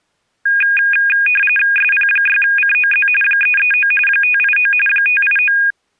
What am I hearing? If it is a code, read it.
RTTY (45.45 baud, 850 Hz shift), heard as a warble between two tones, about 2050 Hz centre. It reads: SP6COZ 339 589 589